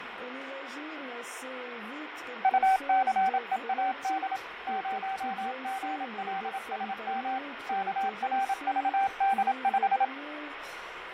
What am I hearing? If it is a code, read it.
Morse code, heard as a keyed tone, machine-sent, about 27 wpm, 780 Hz, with radio static and fading. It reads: UCEAD 0GLSM KRVD5